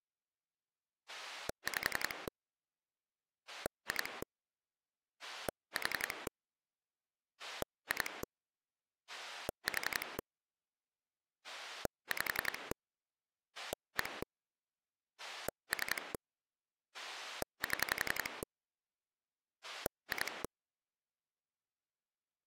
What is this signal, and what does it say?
Pulse dialling, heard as a rotary dial, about 11 pulses a second. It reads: 5 2 4 2 4 5 1 3 7 2